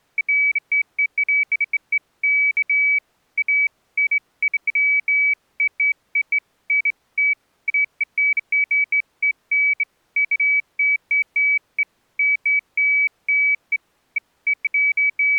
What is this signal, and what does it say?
Beeps of irregular length. There is no code.